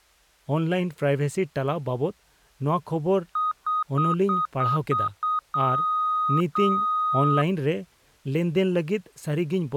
Beep code, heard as beeps, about 1250 Hz, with speech in Santali. 7 short, 2 long.